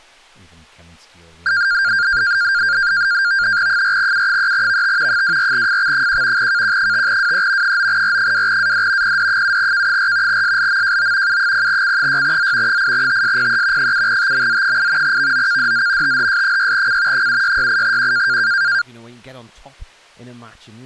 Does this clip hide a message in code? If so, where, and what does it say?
Yes: NAVTEX (SITOR-B), 100 baud, 170 Hz shift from 1.5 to 18.8 s, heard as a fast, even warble, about 1500 Hz centre. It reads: 4U3VT 24FX1 KQ5WE 9R2AD PD7K4 SLMJO U0C6Z 8TSPE 7TMZ8 VOKDZ THS6C 7668Q